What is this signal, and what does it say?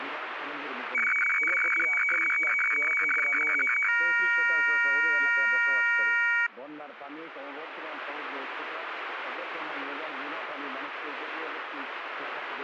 Weather fax (radiofax), 120 lines a minute, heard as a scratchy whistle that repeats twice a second.